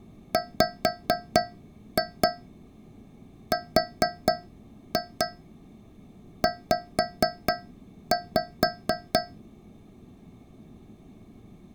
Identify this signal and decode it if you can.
Tap code, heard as taps on a metal pipe, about 4 knocks a second. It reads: WRZ